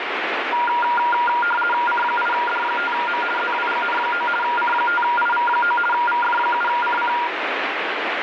RTTY (50 baud, 450 Hz shift), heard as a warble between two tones, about 1180 Hz centre, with radio static. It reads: C8D5M ZWGN9 C5IV9 VF7CC